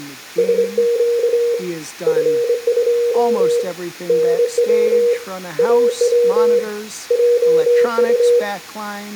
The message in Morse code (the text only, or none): SQ F2 NW AW JU